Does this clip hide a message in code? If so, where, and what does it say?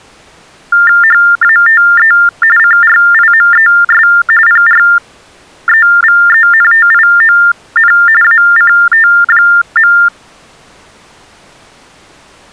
Yes: TTY/TDD text telephone tones (45.45 baud Baudot) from 0.7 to 10.1 s, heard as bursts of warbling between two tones, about 400 Hz shift, 1600 Hz centre. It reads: HATE CRIMES PREVENTION ACT.